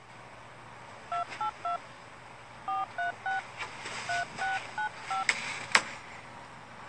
DTMF, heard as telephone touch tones, dialled by hand, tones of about 120 ms, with the noise inside a lift. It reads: 282 436 3695